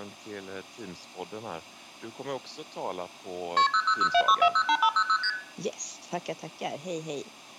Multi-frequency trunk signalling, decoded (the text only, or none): KP 00076408500 ST